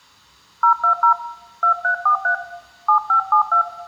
DTMF, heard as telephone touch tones, dialled by hand, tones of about 100 ms, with room echo. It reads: 020 2343 7572